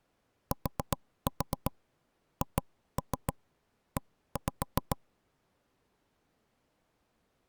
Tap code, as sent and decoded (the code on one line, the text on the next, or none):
4-4 2-3 1-5
THE